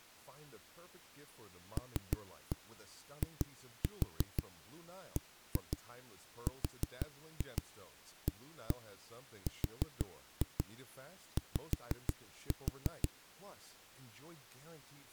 Tap code, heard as knocks on a wall, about 6 knocks a second, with speech in French. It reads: LIBRARY